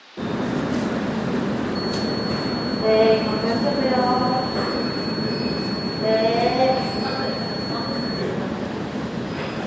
A steady tone, with the noise of a subway station. There is no code.